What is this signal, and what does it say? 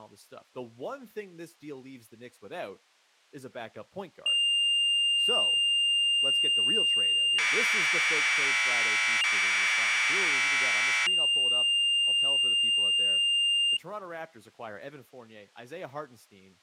Commodore tape loading (standard loader), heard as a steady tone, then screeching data, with speech in English.